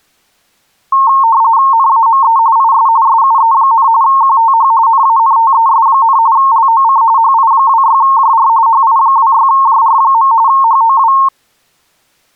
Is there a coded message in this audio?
Yes: RTTY (45.45 baud, 170 Hz shift) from 0.9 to 11.3 s, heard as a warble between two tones, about 1000 Hz centre. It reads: NAME IS SUE, QTH NANTES, LOC HI26JR HI26JR. HOW